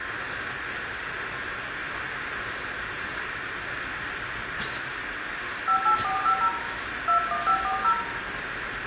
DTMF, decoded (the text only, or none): 58450 21540